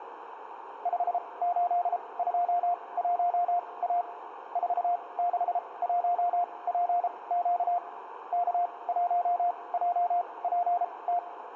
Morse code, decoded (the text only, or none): 5821A 461PQ K1JPT